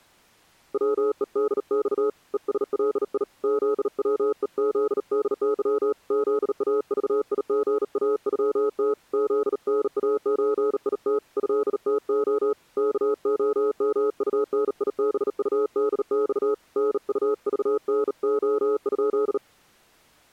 Morse code (Russian alphabet), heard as a keyed tone, hand-sent with a bug key, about 38 wpm, 420 Hz. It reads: ВЕДЬ ЕСЛИ ЗВЕЗДЫ ЗАЖИГАЮТ ЗНАЧИТ ЭТО КОМУНИБУДЬ НУЖНО?